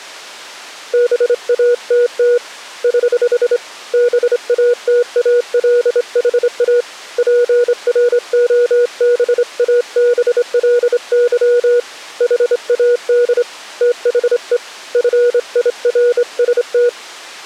Morse code, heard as a keyed tone, hand-sent with a straight key, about 26 wpm, 480 Hz. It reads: BATT <HH> BATALHA PROBABLY HAD THE FIRST